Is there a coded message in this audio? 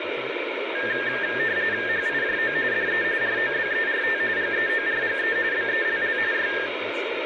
Yes: RTTY (45.45 baud, 170 Hz shift) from 0.8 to 6.7 s, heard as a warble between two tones, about 1700 Hz centre, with radio static and speech in English. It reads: HIJO DE ROBERT GEORGE BELL Y